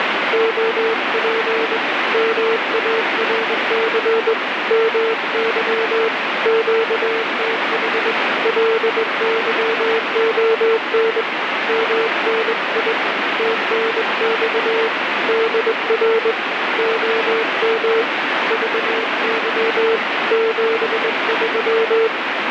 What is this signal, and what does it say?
Morse code, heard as a keyed tone, hand-sent with a straight key, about 21 wpm, 450 Hz, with heavy radio static. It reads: OP MARC MY QTH LYON MNI TNX DR OM VY 73